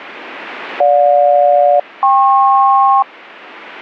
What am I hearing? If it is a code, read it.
Aircraft SELCAL, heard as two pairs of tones. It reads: GJ-KP